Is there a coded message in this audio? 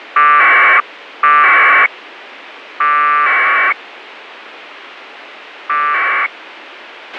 Yes: packet radio (AX.25, as in APRS), 1200 baud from 0.2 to 6.3 s, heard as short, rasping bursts, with radio hiss and a squelch burst at the end.